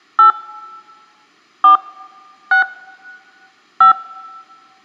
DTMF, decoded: 8 4 6 5

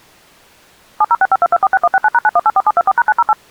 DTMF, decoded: 70652246169#9184724#908

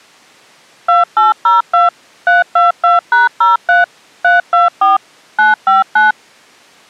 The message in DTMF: 2802 322#03 324 959

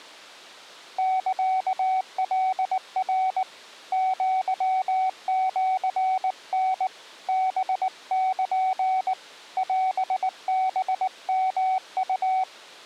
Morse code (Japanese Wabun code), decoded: サカナ アシタ ハル オハヨウ

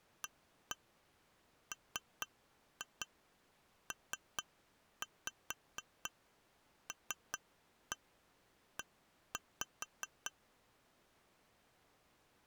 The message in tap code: AMPLE

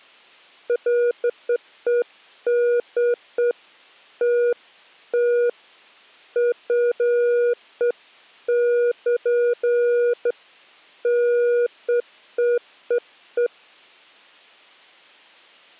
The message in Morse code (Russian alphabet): none

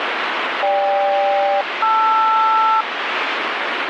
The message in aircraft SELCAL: GK-LR

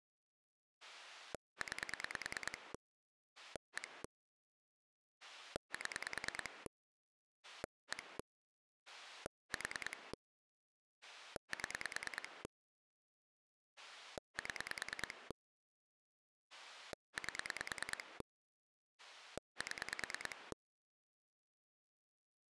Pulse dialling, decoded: 9 1 7 1 4 7 7 8 7

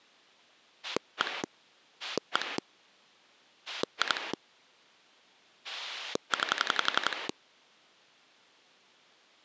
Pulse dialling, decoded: 1 1 2 9

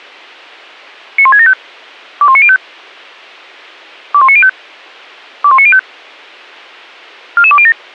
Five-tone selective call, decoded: 91675 21905 21905 21905 44207

